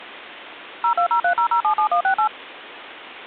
DTMF, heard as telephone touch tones, dialled by machine, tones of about 90 ms. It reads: 02030077168